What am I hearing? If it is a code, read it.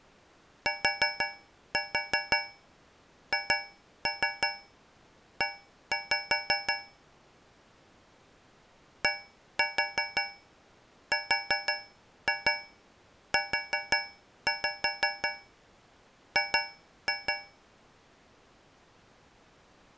Tap code, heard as taps on a metal pipe, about 5 knocks a second. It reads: THE DRUG